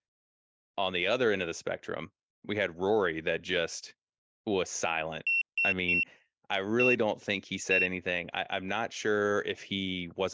Beep code, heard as a piezo beeper, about 2700 Hz, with speech in English. 3-1-1. In Phoenix BIOS tables: DMA register failure.